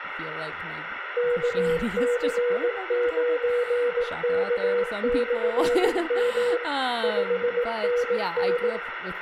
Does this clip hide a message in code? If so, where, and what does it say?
Yes: Morse code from 1.1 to 8.8 s, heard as a keyed tone, machine-sent, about 18 wpm, 480 Hz, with radio static, room echo and speech in English. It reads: KC9K/M 5NN